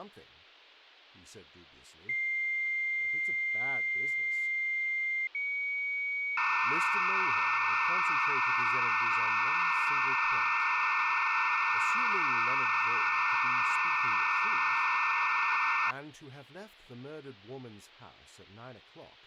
Dial-up modem handshake (low-speed, two carriers), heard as two whistles, then hiss, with speech in English.